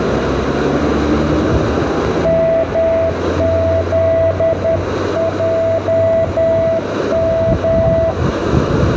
Morse code, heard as a keyed tone, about 11 wpm, 660 Hz, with radio static, a narrow filter, room echo and street noise. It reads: MZJM